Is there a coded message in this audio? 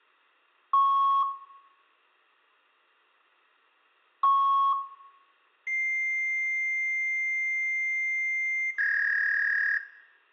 Yes: fax machine handshake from 0.7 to 9.8 s, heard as beeps, a long tone and a warble, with room echo.